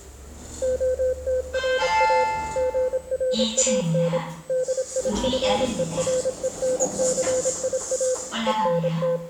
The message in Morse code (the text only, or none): OTRA GRAN DIFERENCIA …